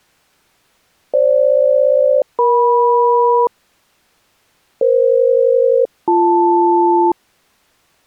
Aircraft SELCAL, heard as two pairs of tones. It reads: FG-EM EF-BL